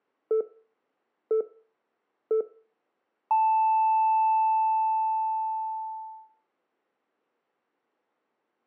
Radio time signal (three low pips and a long one an octave up, as on NHK), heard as pips, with room echo.